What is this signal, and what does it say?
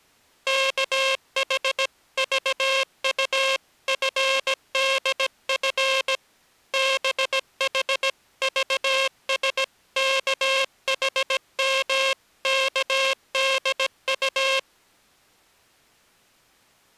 Morse code (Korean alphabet), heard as a buzzer, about 17 wpm. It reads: 우리는 두려움의